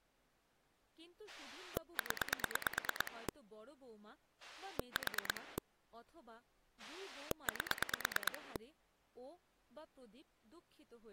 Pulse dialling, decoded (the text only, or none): 0 4 8